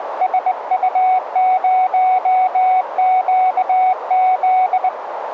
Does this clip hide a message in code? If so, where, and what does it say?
Yes: Morse code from 0.2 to 4.9 s, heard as a keyed tone, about 20 wpm, 740 Hz, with radio static and a narrow filter. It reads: SU0QZ